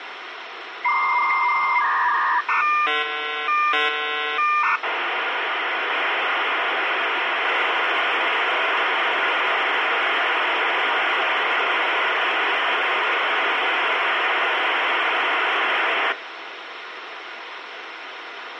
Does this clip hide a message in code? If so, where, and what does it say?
Yes: dial-up modem handshake (V.34 or later) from 0.8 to 16.1 s, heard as a whistle, warbles, then hiss, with phone line noise.